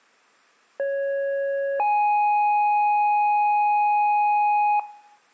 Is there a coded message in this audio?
Yes: two-tone page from 0.8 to 4.8 s, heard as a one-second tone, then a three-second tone, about 550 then 830 Hz, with room echo.